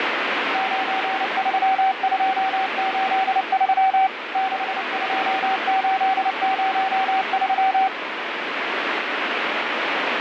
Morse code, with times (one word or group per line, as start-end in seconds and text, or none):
0.5-4.1 93283
4.4-7.9 62803